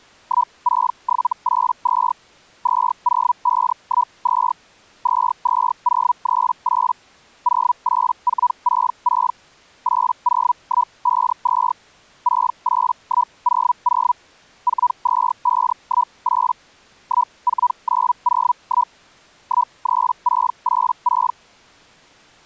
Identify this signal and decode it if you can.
Hellschreiber (Feld-Hell, 122.5 baud), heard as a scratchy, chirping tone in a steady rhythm, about 980 Hz. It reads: 16782 20512 22038 08466 80152 68100 42518 14901 13686